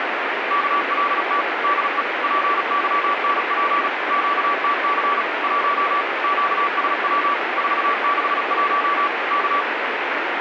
Morse code, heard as a keyed tone, machine-sent, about 36 wpm, 1150 Hz, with radio static. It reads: KLT DE PYNP QTC 1 QSW 461 K